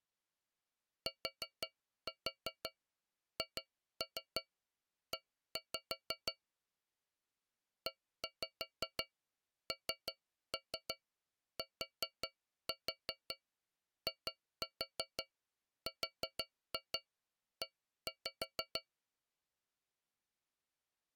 Tap code, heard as taps on a metal pipe, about 5 knocks a second. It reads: THE ENTIRE